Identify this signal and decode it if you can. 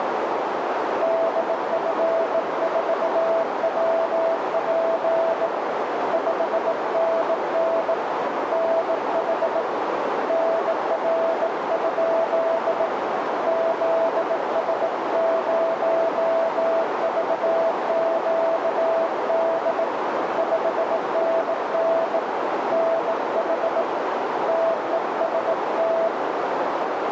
Morse code, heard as a keyed tone, hand-sent with a bug key, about 18 wpm, 660 Hz, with heavy radio static and a narrow filter. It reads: DF4WP 5NN NH NR? ZS0VQD 5NN NH TEST